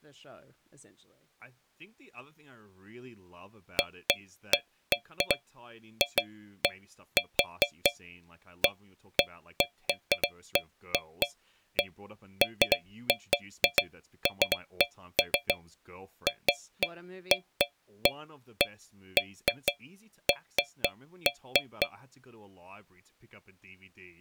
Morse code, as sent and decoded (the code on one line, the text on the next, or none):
none